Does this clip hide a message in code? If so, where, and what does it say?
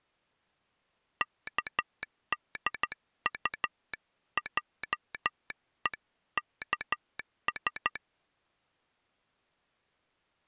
Yes: Morse code (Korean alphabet) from 1.2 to 8.0 s, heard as a telegraph sounder, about 13 wpm. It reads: 의하여